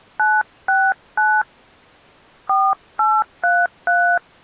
DTMF, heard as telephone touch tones, dialled by hand, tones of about 260 ms. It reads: 969 4833